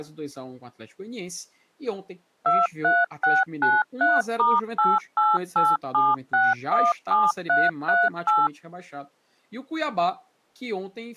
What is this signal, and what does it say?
DTMF, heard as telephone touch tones, dialled by machine, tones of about 200 ms, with speech in Portuguese. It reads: 23693*8887617338